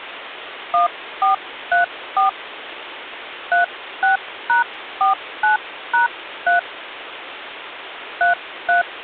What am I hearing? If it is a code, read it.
DTMF, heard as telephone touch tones, dialled by hand, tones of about 130 ms, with phone line noise. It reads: 1434 36#49#3 33